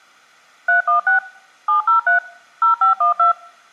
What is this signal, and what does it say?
DTMF, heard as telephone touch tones, dialled by machine, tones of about 120 ms. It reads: 316 703 0512